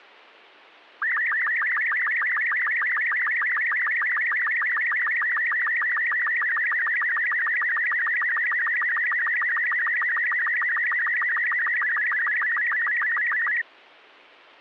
SSTV (slow-scan television), Robot 36, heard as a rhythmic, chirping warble.